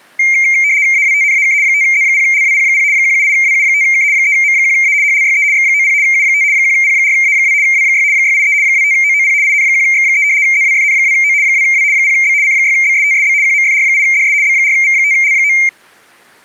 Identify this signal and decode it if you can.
RTTY (75 baud, 170 Hz shift), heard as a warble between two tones, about 2200 Hz centre. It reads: AWTNAK 5Z0LWP0 178WU5K 3M1A HLYE X90 U5 1P4A2 W6 683 25OOP IN1X3 ZWFN2O 2W 0B C6BSTSB QMFR8DS B4V5L9